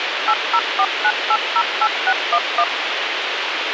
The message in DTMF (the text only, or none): 8049808611